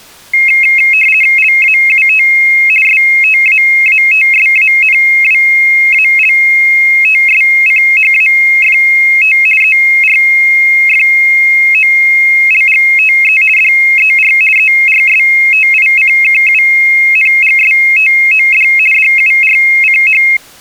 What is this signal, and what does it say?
RTTY (50 baud, 450 Hz shift), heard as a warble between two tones, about 2350 Hz centre. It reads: LAUT STAATSANWALTSCHAFT ERFOLGTE DER ERSTICKUNGSTOD DURCH